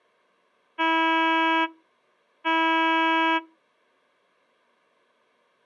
Ship horn signal, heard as a ship's horn, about 320 Hz. 2 short. At sea: I am altering course to port.